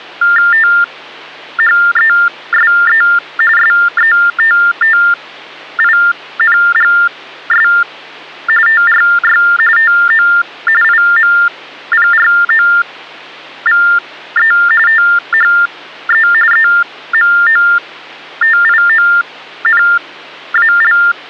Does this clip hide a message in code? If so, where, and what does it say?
Yes: TTY/TDD text telephone tones (45.45 baud Baudot) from 0.2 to 21.1 s, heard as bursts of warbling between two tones, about 400 Hz shift, 1600 Hz centre, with hum. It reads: THESE SETTINGS TRY TO IMPROVE THE EMOTIONAL